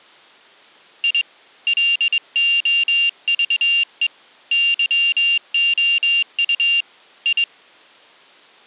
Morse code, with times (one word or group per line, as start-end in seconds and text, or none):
1.0-1.2 I
1.7-4.1 LOVE
4.5-6.8 YOU
7.3-7.4 I